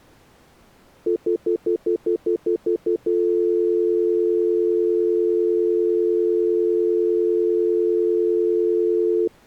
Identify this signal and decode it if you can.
Telephone call progress tone (North American plan), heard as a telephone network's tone, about 350, 440 Hz, 0.1 s on and 0.1 s off. Stutter dial tone.